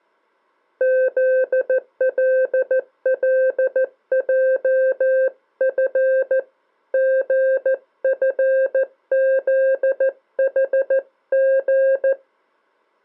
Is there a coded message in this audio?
Yes: Morse code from 0.7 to 12.2 s, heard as a keyed tone, hand-sent with a paddle, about 14 wpm, 530 Hz. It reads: ZLLJF GFZHG